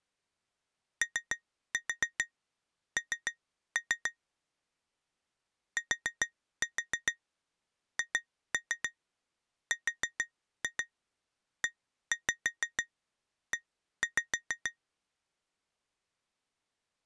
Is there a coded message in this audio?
Yes: tap code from 1.0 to 14.8 s, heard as taps on glass, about 6 knocks a second. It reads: ON THREE